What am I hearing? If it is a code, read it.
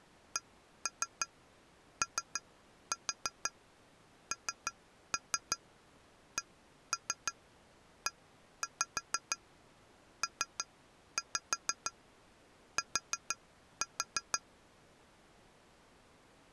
Tap code, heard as taps on glass, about 6 knocks a second. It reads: CONCEPT